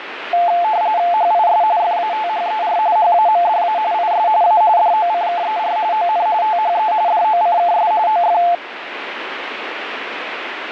RTTY (45.45 baud, 170 Hz shift), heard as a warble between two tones, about 780 Hz centre, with radio static. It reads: HIS FATHER HAMDA IS A DOCKER ON THE DOCKS OF